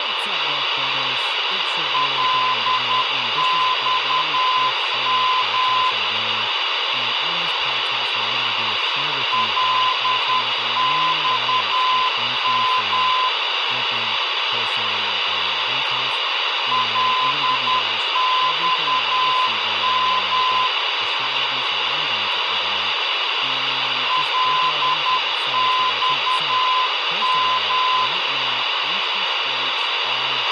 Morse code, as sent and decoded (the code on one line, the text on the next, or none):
.-.. -..- -- / .-.. -..- -- / .-.. -..- -- / .-.. -..- --
LXM LXM LXM LXM